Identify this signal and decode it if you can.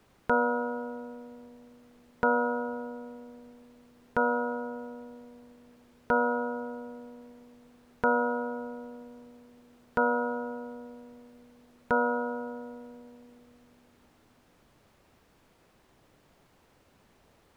Clock strike, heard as a bell. 7. Seven o'clock.